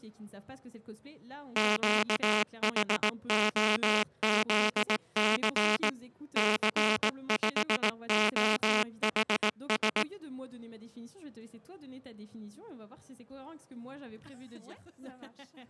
Morse code, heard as a buzzer, machine-sent, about 18 wpm. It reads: QHOZC C5OHS